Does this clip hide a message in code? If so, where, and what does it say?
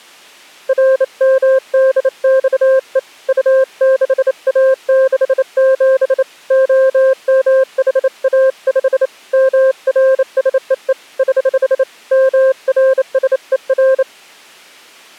Yes: Morse code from 0.6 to 14.1 s, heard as a keyed tone, hand-sent with a bug key, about 28 wpm, 530 Hz. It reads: RMDXE U6A67 OMHA5 MRSEE <HH> MRSER